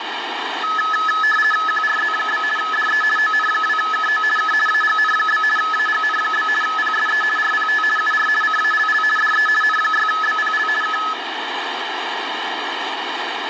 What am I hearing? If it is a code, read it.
RTTY (50 baud, 450 Hz shift), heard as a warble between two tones, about 1500 Hz centre, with radio static. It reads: QRZ? DE ON2KO K AGN? AGN? PSE RPT UR CALL DE N6BPL K